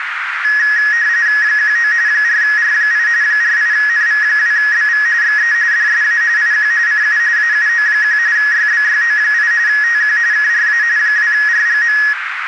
RTTY (45.45 baud, 170 Hz shift), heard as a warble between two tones, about 1800 Hz centre, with radio static and a narrow filter. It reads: 19 4R8 48NV2BV XE DSA IQ CU AUO1 YBYO8 TQ KRA 2RGM